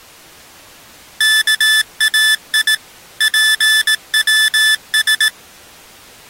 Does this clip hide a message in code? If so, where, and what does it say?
Yes: Morse code (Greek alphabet) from 1.1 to 5.3 s, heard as electronic beeps, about 18 wpm, 1750 Hz. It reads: ΚΑΙ ΠΩΣ